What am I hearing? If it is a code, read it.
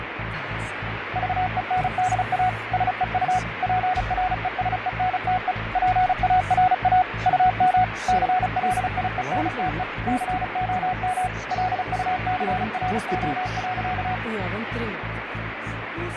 Morse code, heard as a keyed tone, machine-sent, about 35 wpm, 740 Hz, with radio static and fading. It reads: VENDA SEU PRESENTE PARA UM CLIENTE COM LUCRO.